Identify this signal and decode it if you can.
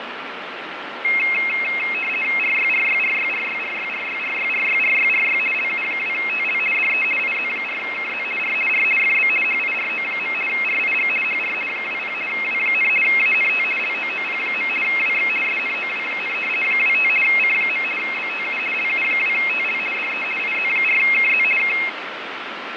RTTY (50 baud, 450 Hz shift), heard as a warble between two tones, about 2350 Hz centre, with radio static and fading. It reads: RYRYRYRYRYRYRYRYRYRY LU2TL DE IZ4KZ R R FB HIRO. RIG HR 20 W, ANT LOOP. WX SNOW, 25 C. BTU LU2TL DE IZ4KZ K